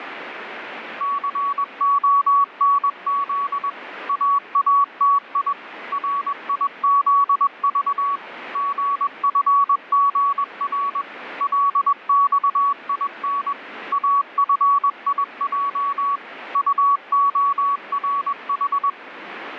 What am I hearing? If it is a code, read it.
Morse code, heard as a keyed tone, machine-sent, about 21 wpm, 1130 Hz, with radio static. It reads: CONZ AATI RIZV GFGR LXIN AFIJ UORH